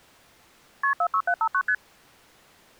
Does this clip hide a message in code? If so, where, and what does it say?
Yes: multi-frequency trunk signalling (R1, as on North American trunks) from 0.8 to 1.7 s, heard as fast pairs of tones, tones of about 70 ms. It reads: KP 46759 ST